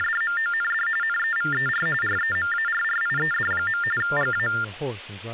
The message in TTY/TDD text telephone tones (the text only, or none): … NEVER REMARRIED. GA